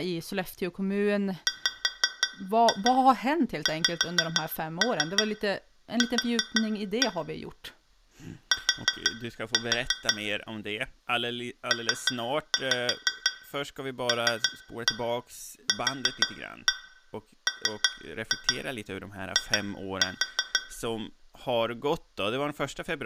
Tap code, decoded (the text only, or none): WXQ T PLQMI